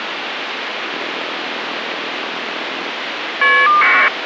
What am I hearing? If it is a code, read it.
Caller ID data burst, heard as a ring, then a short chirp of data, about 1200 baud, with phone line noise.